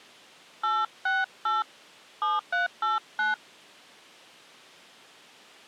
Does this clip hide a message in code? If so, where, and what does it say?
Yes: DTMF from 0.6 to 3.3 s, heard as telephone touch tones, dialled by hand, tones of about 160 ms. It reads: 868 7389